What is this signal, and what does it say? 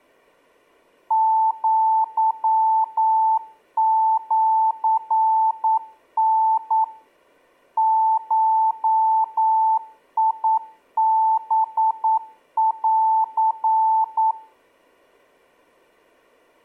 Morse code (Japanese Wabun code), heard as a keyed tone, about 9 wpm, 880 Hz. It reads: アシタ ゴハン